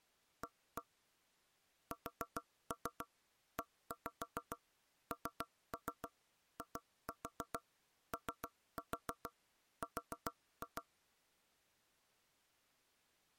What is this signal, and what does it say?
Tap code, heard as knocks on wood, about 7 knocks a second. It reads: A SENIOR